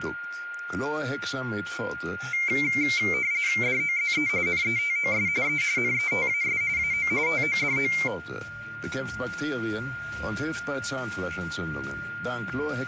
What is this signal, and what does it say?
RTTY (45.45 baud, 170 Hz shift), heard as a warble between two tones, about 2200 Hz centre, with a steady whistle near 1410 Hz. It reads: DOZE NETOS E NETAS AO TODO